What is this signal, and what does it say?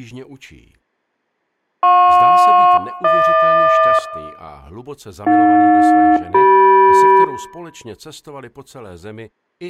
Aircraft SELCAL, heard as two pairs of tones, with room echo. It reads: JP-HQ AJ-CM